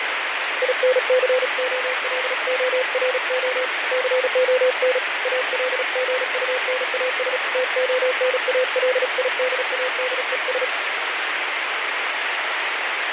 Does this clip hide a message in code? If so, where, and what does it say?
Yes: Morse code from 0.6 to 10.7 s, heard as a keyed tone, hand-sent with a paddle, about 36 wpm, 510 Hz, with heavy radio static and fading. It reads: INCOLORO CON ALGUNAS TONALIDADES